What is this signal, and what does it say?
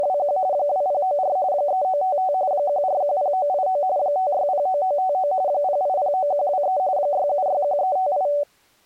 RTTY (45.45 baud, 170 Hz shift), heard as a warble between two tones, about 670 Hz centre. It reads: … 2094 3955 1410989 5609959 0809123 6761358